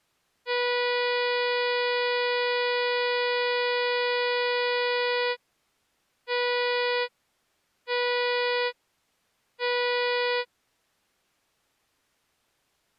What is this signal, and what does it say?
Ship horn signal, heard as a ship's horn, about 490 Hz. 1 long, 3 short. At sea: a vessel under tow in fog.